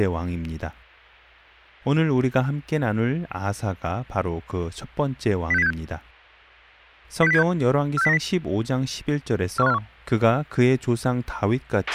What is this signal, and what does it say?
Five-tone selective call (EEA), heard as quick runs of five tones, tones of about 40 ms, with a squelch burst at the end and speech in Korean. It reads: 06076 06076 46090 41541